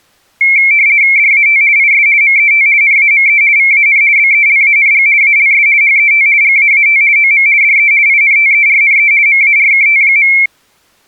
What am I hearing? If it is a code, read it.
RTTY (50 baud, 170 Hz shift), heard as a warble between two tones, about 2250 Hz centre. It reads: DAT IS MET NAME VAN BELANG ALS HET GAAT OM DE INTERNE MARKT.